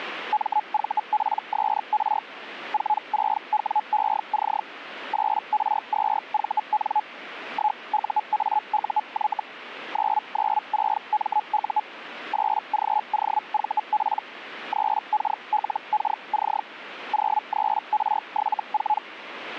Hellschreiber (Feld-Hell, 122.5 baud), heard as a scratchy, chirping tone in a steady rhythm, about 850 Hz. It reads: MVPSR 46WEC 8R2VN 1UAUY 996MU 8GOVP 3KLKC 03R74